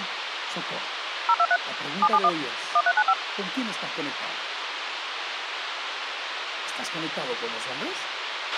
DTMF, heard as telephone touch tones, dialled by machine, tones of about 60 ms, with radio hiss, a squelch burst at the end and speech in Spanish. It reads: 023 771 1395